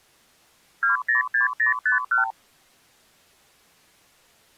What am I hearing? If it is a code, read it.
Multi-frequency trunk signalling (R2, with the far end's replies), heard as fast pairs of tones, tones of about 130 ms. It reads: 206051